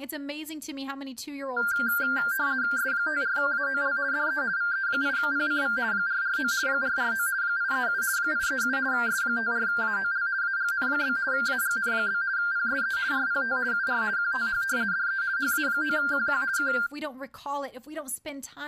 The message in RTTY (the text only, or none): S54AOL DE VE8PCV 449 449 837 837 S54AOL AGN? AGN? PSE RPT UR QTH DE HA9QQ K